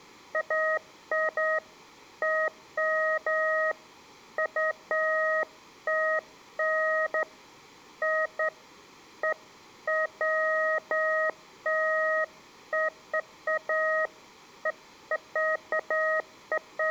Beeps of irregular length, with room echo. There is no code.